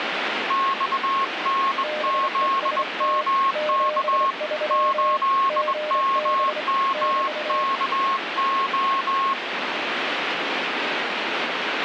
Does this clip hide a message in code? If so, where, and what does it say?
Yes: Morse code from 0.4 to 9.4 s, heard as two keyed tones, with radio static. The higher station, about 21 wpm, 1080 Hz: XNZMK 8MMKO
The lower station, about 27 wpm, 610 Hz: BEST 73 GB <BT>